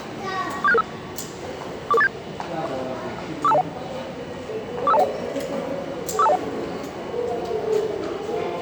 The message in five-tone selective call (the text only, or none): 47665 44487 45201 45201 45201